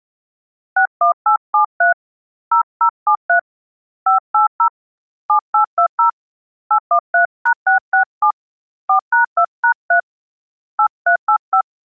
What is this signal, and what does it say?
DTMF, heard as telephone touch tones, dialled by hand, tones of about 100 ms. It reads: 61873 0073 580 7820 813#667 4#2#3 8385